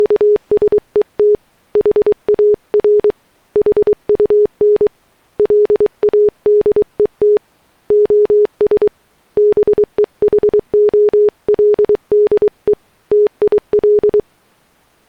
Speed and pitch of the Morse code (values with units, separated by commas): 23 wpm, 420 Hz